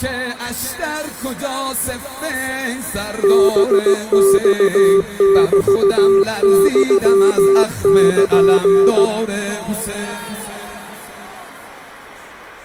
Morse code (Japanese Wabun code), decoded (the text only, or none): ハマメユル